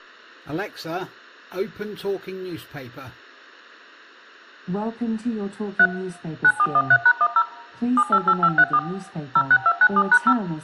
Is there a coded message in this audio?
Yes: DTMF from 5.8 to 10.3 s, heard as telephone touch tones, dialled by machine, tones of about 60 ms. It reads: 3 9413#10 788534 06297#0